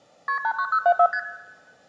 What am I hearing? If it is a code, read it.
Multi-frequency trunk signalling (R1, as on North American trunks), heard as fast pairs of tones, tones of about 70 ms, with room echo. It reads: KP 89074 ST